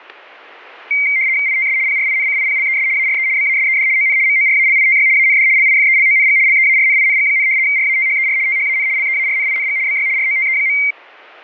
RTTY (75 baud, 170 Hz shift), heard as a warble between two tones, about 2200 Hz centre, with static crashes. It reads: ITS PRINCIPLES ARE BASED ON MORALITY AND LIFELONG LEARNING, RATHER THAN LEARNING BY ROTE.